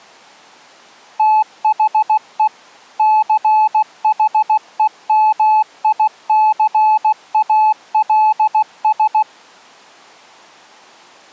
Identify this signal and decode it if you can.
Morse code, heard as a keyed tone, machine-sent, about 16 wpm, 860 Hz. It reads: THE CHEMICALS